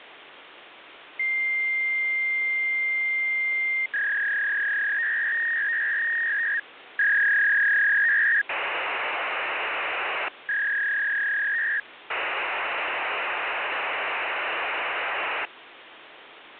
Fax machine handshake, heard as a long tone, a warble and hiss, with phone line noise.